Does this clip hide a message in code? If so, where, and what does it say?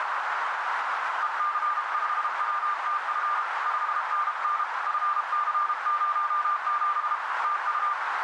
Yes: Morse code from 1.2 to 8.0 s, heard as a keyed tone, hand-sent with a paddle, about 32 wpm, 1190 Hz, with heavy radio static and a narrow filter. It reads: EC5WTF 5NN FC07 TU